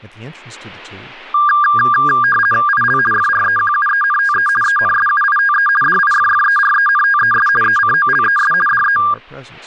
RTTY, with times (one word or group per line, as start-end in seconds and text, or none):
2.7-3.0 IL
3.1-4.5 FREQUENTE
4.6-5.7 ENSUITE
5.8-7.5 DIFFERENTES
7.6-8.5 ECOLES
8.7-9.0 DE